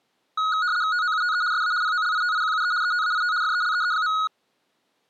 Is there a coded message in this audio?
Yes: RTTY (75 baud, 170 Hz shift) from 0.4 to 4.3 s, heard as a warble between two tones, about 1360 Hz centre. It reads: TOUTE SA POLITIQUE ETAIT FELEE.